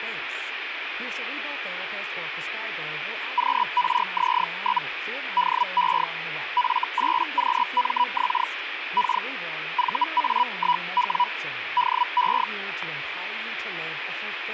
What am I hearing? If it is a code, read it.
Hellschreiber (Feld-Hell, 122.5 baud), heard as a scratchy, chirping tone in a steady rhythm, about 980 Hz, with radio static and speech in English. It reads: QRZ? DE F8QMX K VA1W DE